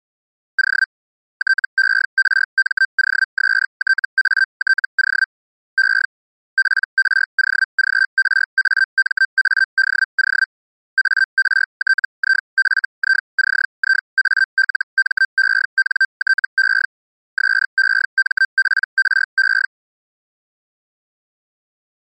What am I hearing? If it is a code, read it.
Hellschreiber (Feld-Hell, 122.5 baud), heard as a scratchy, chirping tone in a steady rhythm, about 1550 Hz. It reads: O TERMOSTATO E PROGRAMADO ARTIFICIALMENTE SEMPRE